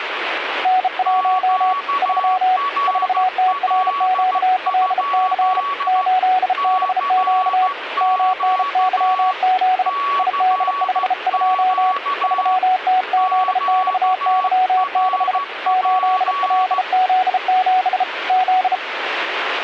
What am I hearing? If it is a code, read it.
Morse code, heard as two keyed tones, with radio static. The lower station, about 33 wpm, 740 Hz: N1 3 4TRQLC 8BQ MNYZ ID52 3TZXY6 8LZ7 Z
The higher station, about 14 wpm, 1130 Hz: QRL? CQ CQ QRP